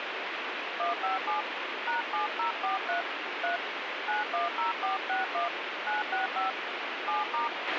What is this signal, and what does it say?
DTMF, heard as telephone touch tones, dialled by hand, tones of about 140 ms, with radio hiss and a squelch burst at the end. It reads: 157 #7043 3 910461 965 7*